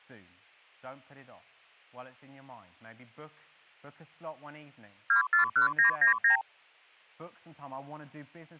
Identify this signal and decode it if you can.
Multi-frequency trunk signalling (R2, with the far end's replies), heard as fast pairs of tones, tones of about 110 ms, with speech in English. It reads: 241999